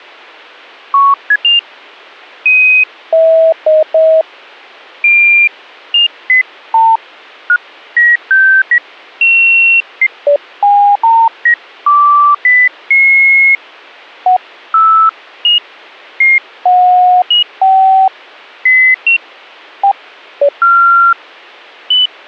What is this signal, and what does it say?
Electronic bleeps of random pitch and length. There is no code.